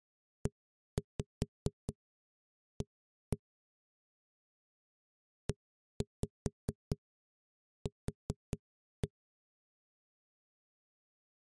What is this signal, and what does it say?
Tap code, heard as knocks on a wall, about 4 knocks a second. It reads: EA EQ